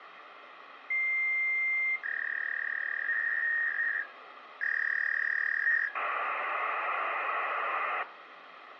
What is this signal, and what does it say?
Fax machine handshake, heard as a long tone, a warble and hiss, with phone line noise and room echo.